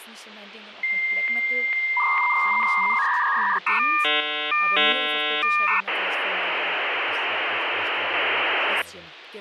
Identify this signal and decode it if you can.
Dial-up modem handshake (V.34 or later), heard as a whistle, warbles, then hiss, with phone line noise and speech in German.